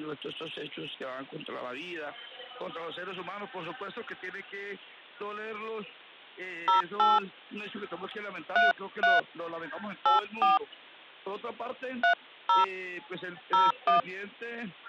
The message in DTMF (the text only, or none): 08 33 84 30 01